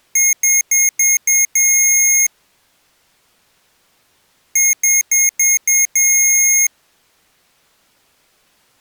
Beep code, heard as beeps from a small speaker, played twice, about 2150 Hz. 5 short, 1 long.